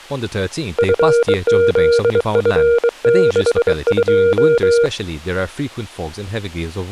Morse code, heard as a keyed tone, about 23 wpm, 470 Hz, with speech in English. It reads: FZF62